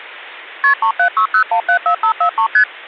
Multi-frequency trunk signalling (R1, as on North American trunks), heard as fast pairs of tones, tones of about 90 ms. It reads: KP 3760174543 ST